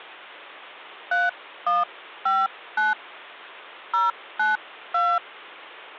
DTMF, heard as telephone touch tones, dialled by hand, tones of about 190 ms, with hum. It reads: 3159 092